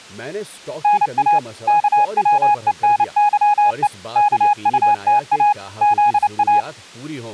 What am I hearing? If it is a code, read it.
Morse code, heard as a keyed tone, machine-sent, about 29 wpm, 830 Hz, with speech in Urdu. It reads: NA KWENYE KUTA ZA